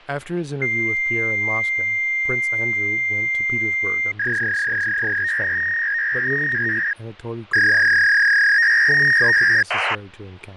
Fax machine handshake, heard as a long tone and a warble, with speech in English.